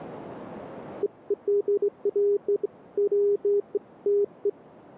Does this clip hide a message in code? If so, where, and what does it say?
No, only beeps of irregular length.